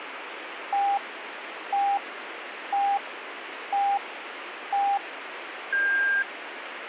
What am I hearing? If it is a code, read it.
Radio time signal (five pips and a higher one, as on Chinese radio), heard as pips, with radio static.